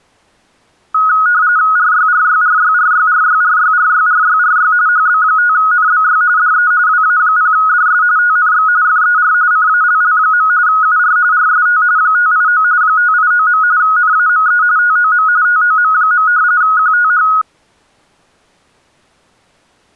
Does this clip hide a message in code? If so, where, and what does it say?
Yes: RTTY (45.45 baud, 170 Hz shift) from 0.9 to 17.4 s, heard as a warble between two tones, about 1360 Hz centre. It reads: RYRYRYRYRYRYRYRYRY HB5NBY DE WA0DS TNX FER CALL. UR RST 589 589. NAME TOM TOM. QTH